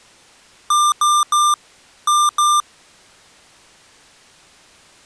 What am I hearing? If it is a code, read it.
Beep code, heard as beeps from a small speaker, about 1190 Hz. 3-2.